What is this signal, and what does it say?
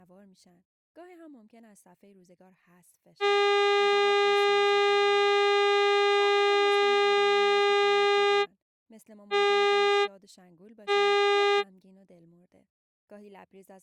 Ship horn signal, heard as a ship's horn, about 400 Hz, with speech in Persian. 1 long, 2 short. At sea: a vessel in fog that is sailing, fishing, towing or hampered.